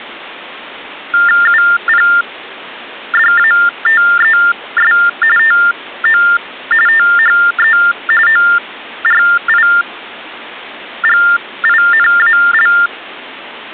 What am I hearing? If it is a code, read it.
TTY/TDD text telephone tones (45.45 baud Baudot), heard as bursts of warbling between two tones, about 400 Hz shift, 1600 Hz centre. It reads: UPDATES TO THE ORIGINAL